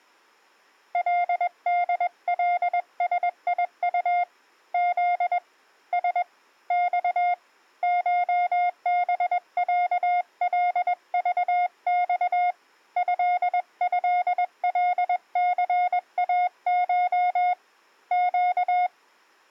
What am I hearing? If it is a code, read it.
Morse code (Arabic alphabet), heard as a keyed tone, hand-sent with a paddle, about 21 wpm, 710 Hz. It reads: لدلسيط ذ س ص شبعلضص ههلثاش ق